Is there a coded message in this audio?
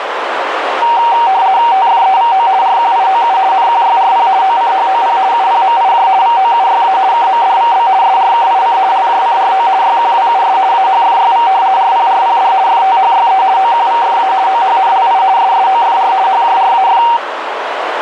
Yes: RTTY (50 baud, 170 Hz shift) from 0.8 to 17.2 s, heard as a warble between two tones, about 850 Hz centre, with radio static and a narrow filter. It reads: TFEVO RQIOU NQYRP OCHOP UPMIJ VOUYA KMDVB SRKIC LJCRO YQWUS AHFYV RPRPD FTHYE OQVFA OHNLI SSOFR HJRAF